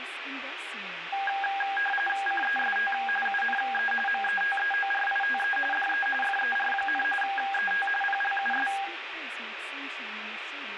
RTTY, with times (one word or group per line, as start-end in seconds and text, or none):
2.3-2.9 CEST
3.3-3.9 UNE
4.1-5.6 METEORITE
5.7-6.1 DE
6.2-7.0 FER,
7.2-7.9 ET
8.0-8.7 PLUS